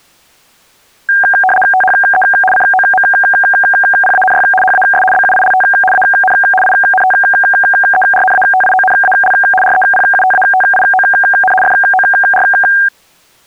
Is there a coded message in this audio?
Yes: RTTY (75 baud, 850 Hz shift) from 1.1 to 12.9 s, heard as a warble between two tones, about 1180 Hz centre. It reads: THE COMPANY HAS BUILT AN INTERNATIONAL REPUTATION FOR